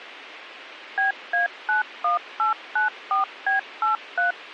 DTMF, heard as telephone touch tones, dialled by machine, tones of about 130 ms. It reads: BA91894B83